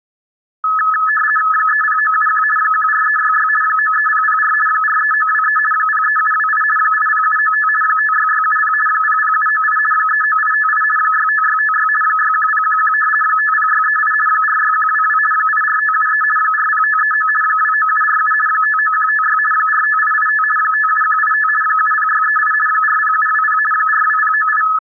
RTTY (50 baud, 450 Hz shift), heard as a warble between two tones, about 1500 Hz centre. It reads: 30971 14366 93004 43923 03728 80795 56670 00798 39858 65656 61011 50638 46122 84573 40539 29747 59156 45885 57185 70638 40720 42098